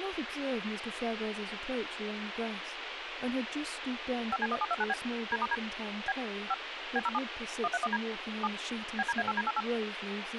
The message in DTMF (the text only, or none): 5C1729B D*D B 5 B07 131D 7 BDA8D88